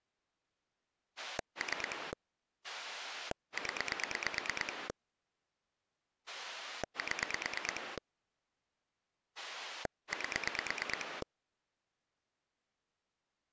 Pulse dialling, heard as a rotary dial, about 9 pulses a second. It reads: 3 0 7 8